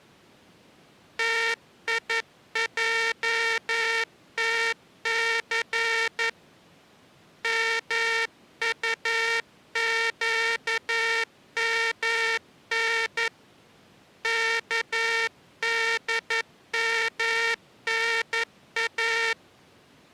Morse code (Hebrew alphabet), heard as a buzzer, hand-sent with a paddle, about 11 wpm. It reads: תיעתס מטקמן כדמנא